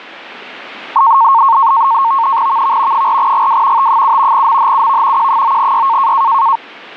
NAVTEX (SITOR-B), 100 baud, 170 Hz shift, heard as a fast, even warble, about 1000 Hz centre. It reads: VV 4GW T7 MHUV Q9Y